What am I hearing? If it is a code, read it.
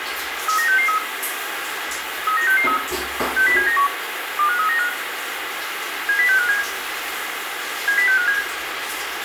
Five-tone selective call (CCIR), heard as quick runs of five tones, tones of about 100 ms, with radio hiss, a squelch burst at the end, room echo and the noise of a restroom. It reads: 39663 39663 60791 25395 70657 70657